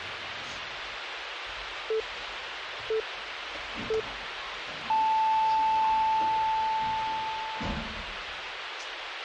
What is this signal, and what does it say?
Radio time signal (three low pips and a long one an octave up, as on NHK), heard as pips, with radio hiss and the noise inside a lift.